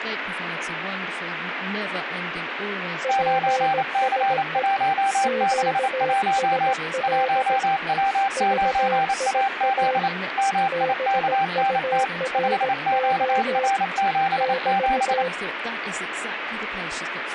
Morse code, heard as two keyed tones, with radio static. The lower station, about 17 wpm, 520 Hz: PSE QSL VIA BURO <BT>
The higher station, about 28 wpm, 780 Hz: 9C161 1W9AZ MIKNT 5QR77